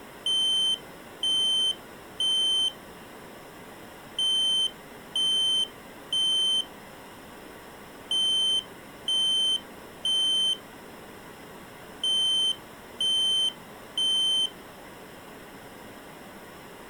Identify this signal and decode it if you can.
Alarm pattern, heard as an alarm's beeps, played four times, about 3100 Hz. Temporal three. Smoke or fire, evacuate.